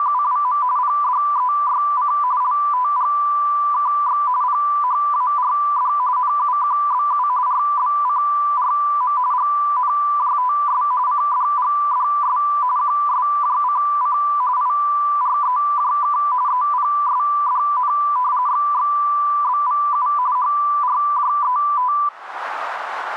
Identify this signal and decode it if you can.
RTTY (45.45 baud, 170 Hz shift), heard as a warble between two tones, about 1080 Hz centre. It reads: … PDEYC LTGKX PHARD NUQBU RBCRM GNJTS CDGDS QSJCC IREJK EPSDN XXBVU HRJET